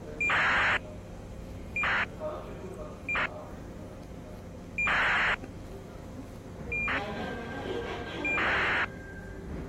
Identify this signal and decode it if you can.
ACARS aircraft data, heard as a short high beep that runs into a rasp, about 2400 baud, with the noise of a subway station.